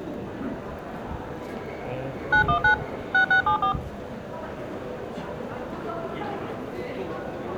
DTMF, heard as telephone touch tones, dialled by machine, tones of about 100 ms, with the noise of a crowd indoors. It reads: 919 6674